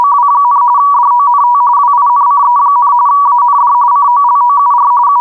RTTY (45.45 baud, 170 Hz shift), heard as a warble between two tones, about 1050 Hz centre. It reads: … DONT WINCE, AND COLOUR …